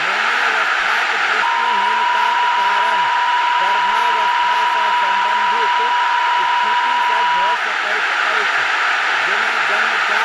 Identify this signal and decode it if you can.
PSK63 (62.5 baud), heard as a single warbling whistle, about 970 Hz, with radio static, a narrow filter and speech in Maithili.